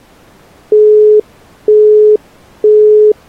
Telephone call progress tone (single-tone plan, as in Europe, Japan and elsewhere), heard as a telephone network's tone, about 420 Hz, 0.48 s on and 0.48 s off. Busy tone.